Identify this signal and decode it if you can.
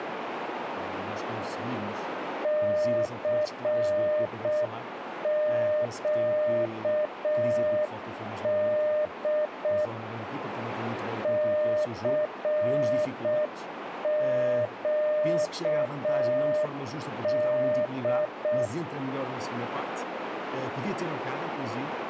Morse code, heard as a keyed tone, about 6 wpm, 610 Hz, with radio static and a narrow filter. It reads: CQD CQD